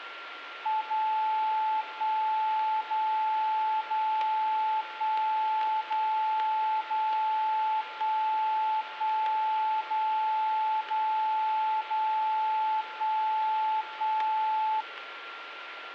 Radio time signal (DCF77), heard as a tone whose level steps once a second, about 870 Hz, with radio static and a steady whistle near 1380 Hz. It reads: 0 1 0 0 1 0 0 1 1 0 0 0 1 1